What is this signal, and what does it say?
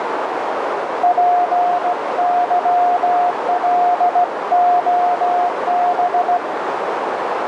Morse code, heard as a keyed tone, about 16 wpm, 710 Hz, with heavy radio static and a narrow filter. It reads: PYLOB